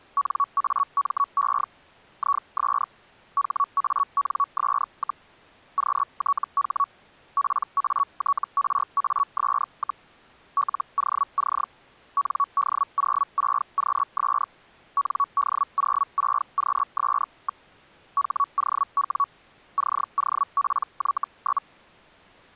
Hellschreiber (Feld-Hell, 122.5 baud), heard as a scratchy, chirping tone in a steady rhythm, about 1120 Hz. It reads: NAME IS HANS, QTH PATRAS, LOC ND06QS ND06QS. HOW COPY?